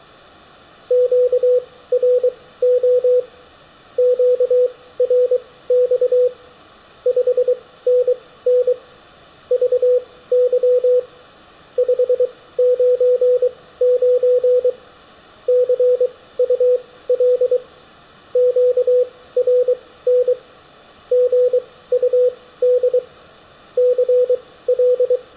Morse code, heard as a keyed tone, machine-sent, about 23 wpm, spaced as for 16 wpm, 500 Hz, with room echo. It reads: QRO QRX 5NN VY 599 CUL QRN GUD CL